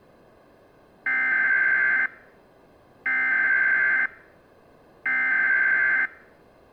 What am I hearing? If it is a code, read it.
Emergency Alert System (SAME) tones (header bursts), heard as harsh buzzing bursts, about 520.83 baud.